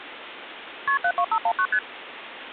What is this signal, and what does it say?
Multi-frequency trunk signalling (R1, as on North American trunks), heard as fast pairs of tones, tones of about 70 ms, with phone line noise. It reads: KP 72519 ST